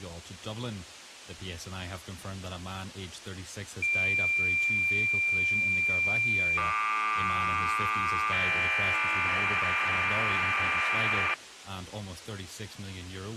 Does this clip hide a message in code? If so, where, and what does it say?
Yes: cassette data (Kansas City type), 1200 baud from 3.8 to 11.3 s, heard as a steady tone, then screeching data.